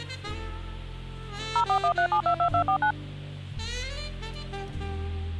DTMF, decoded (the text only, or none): 0413722249